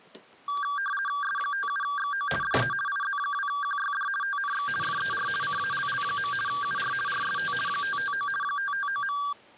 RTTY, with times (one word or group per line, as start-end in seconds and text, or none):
1.2-2.3 S57XO
2.4-2.7 DE
2.9-4.1 IZ2QYD
4.2-4.7 TNX
4.8-5.3 FER
5.4-6.3 CALL.
6.5-6.9 UR
7.1-7.5 RST
7.7-8.3 559
8.4-9.2 559.